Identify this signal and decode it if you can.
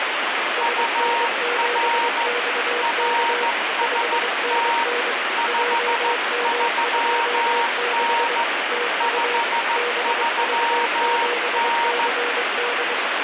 Morse code, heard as two keyed tones, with heavy radio static. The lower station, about 23 wpm, 480 Hz: SN7XK 5NN JM26 TU BV7CD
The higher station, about 14 wpm, 930 Hz: UR RST 53N 53N